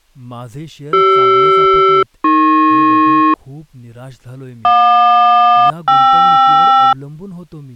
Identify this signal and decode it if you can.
Aircraft SELCAL, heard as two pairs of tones, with speech in Marathi. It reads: CR-AP JQ-KR